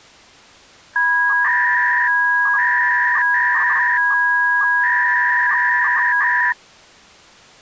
300-baud modem data (V.21 tones), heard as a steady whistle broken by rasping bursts, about 300 baud, 200 Hz shift.